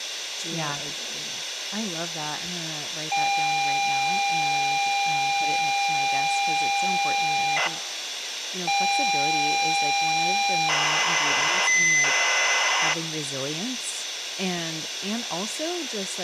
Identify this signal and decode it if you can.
ZX Spectrum tape loading, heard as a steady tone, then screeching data, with tape hiss and speech in English.